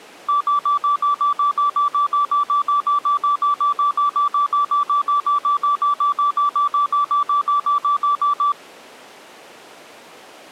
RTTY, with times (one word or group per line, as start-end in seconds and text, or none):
none